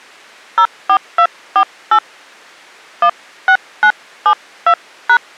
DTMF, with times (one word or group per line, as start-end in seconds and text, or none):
0.6-2.0 04248
3.0-5.2 16972#